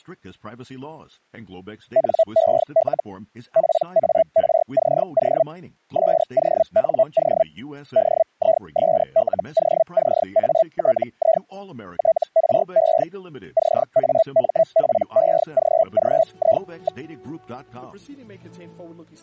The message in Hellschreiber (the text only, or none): NEL PARCO SONO DISLOCATI TRE CAMPEGGI.